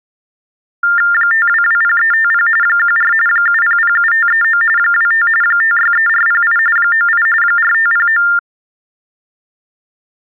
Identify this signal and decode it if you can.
TTY/TDD text telephone tones (45.45 baud Baudot), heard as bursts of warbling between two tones, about 400 Hz shift, 1600 Hz centre. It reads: 5220350 14 7007539 25 563408 98 4509